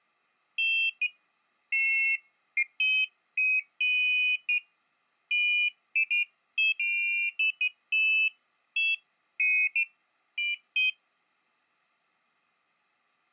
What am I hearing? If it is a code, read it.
Pairs of high tones at irregular times. There is no code.